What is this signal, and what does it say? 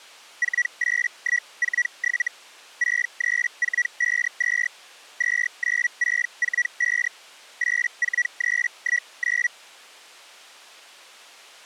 Hellschreiber (Feld-Hell, 122.5 baud), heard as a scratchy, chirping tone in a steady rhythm, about 1950 Hz. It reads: 48147 63452 29645 84319